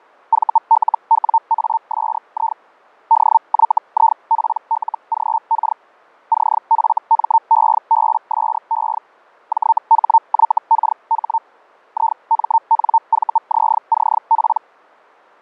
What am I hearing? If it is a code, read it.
Hellschreiber (Feld-Hell, 122.5 baud), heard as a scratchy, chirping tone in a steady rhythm, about 900 Hz, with fading. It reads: VLWASI DYIPLGK CFMEBSE JHYKH IMNVZCP